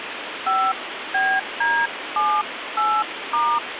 DTMF, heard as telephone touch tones, dialled by hand, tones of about 260 ms, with phone line noise. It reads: 5BD78*